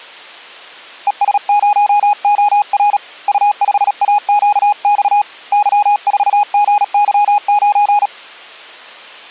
Morse code, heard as a keyed tone, hand-sent with a paddle, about 37 wpm, 830 Hz. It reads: ES0OR U5AQX Y4GY9